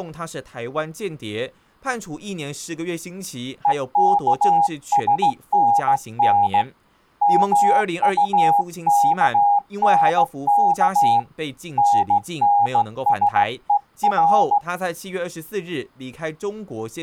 Morse code, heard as a keyed tone, hand-sent with a straight key, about 16 wpm, 810 Hz, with speech in Chinese. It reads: EKSNN MUKNK NNSER